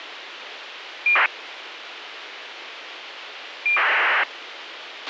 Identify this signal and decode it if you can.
ACARS aircraft data, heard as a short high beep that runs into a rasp, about 2400 baud, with radio hiss and a squelch burst at the end.